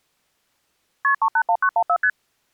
Multi-frequency trunk signalling (R1, as on North American trunks), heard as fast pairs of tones, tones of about 70 ms. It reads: KP 381914 ST